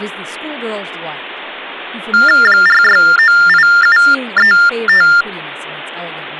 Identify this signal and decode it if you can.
TTY/TDD text telephone tones (45.45 baud Baudot), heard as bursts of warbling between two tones, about 400 Hz shift, 1600 Hz centre, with speech in English. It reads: 4698735